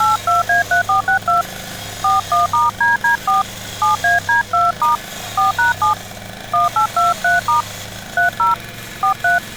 DTMF, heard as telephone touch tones, dialled by hand, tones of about 140 ms, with street noise. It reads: 82A3462 41*DD4 7AD2* 4#7 1823* 30 43